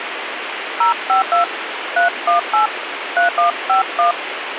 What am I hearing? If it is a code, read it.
DTMF, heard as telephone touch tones, dialled by hand, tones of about 120 ms, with radio hiss. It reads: 052 318 3151